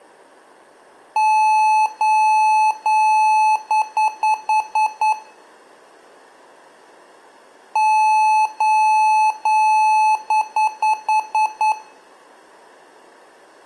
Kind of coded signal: beep code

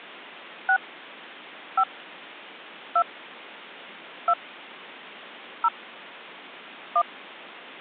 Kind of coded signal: DTMF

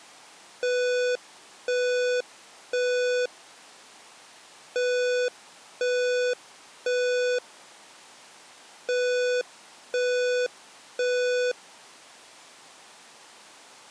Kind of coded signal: alarm pattern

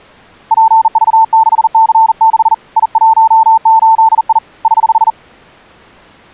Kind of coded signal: Morse code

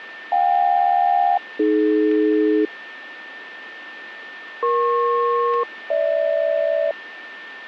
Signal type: aircraft SELCAL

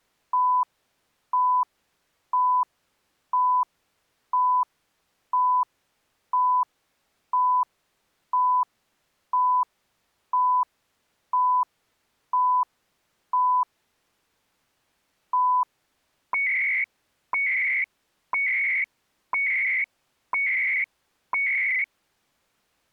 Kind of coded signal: radio time signal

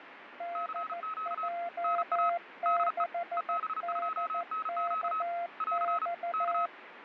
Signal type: Morse code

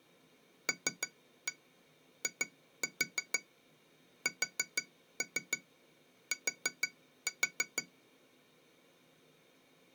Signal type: tap code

